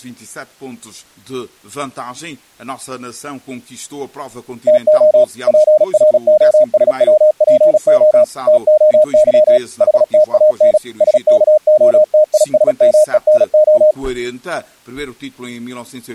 Morse code (Greek alphabet), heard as a keyed tone, machine-sent, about 36 wpm, 610 Hz. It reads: ΤΟ ΠΡΟΣΩΠΟ ΤΟΥ ΗΤΑΝ ΣΚΟΤΙΣΜΕΝΟ